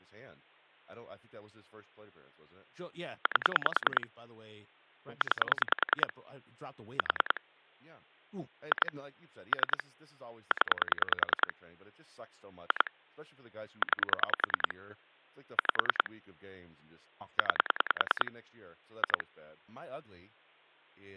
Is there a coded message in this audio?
Yes: pulse dialling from 3.3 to 19.2 s, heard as clicks on a phone line, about 10 pulses a second, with speech in English. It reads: 8 9 4 2 3 0 2 9 5 9 2